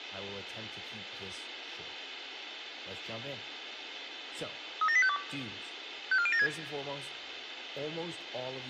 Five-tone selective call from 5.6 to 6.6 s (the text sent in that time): 54076